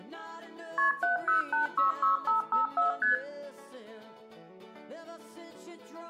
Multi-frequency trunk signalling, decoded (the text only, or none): KP 70866554 ST